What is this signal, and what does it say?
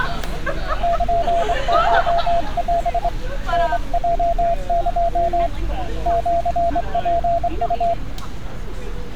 Morse code (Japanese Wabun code), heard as a keyed tone, hand-sent with a straight key, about 24 wpm, 680 Hz, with street noise. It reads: ルコオ タヲエ シツウ